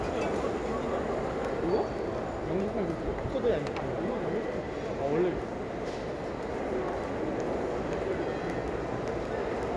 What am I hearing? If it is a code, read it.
The noise of a restaurant. There is no code.